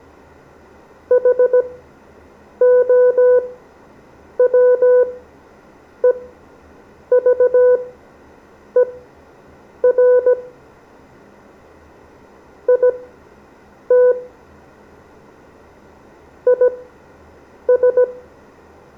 Morse code, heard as a keyed tone, machine-sent, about 17 wpm, spaced as for 7 wpm, 500 Hz, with room echo. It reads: HOWEVER IT IS